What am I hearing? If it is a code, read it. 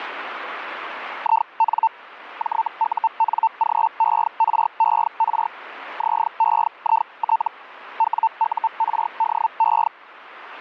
Hellschreiber (Feld-Hell, 122.5 baud), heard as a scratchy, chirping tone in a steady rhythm, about 900 Hz, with radio static. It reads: IN JUNGERER ZEIT WURDE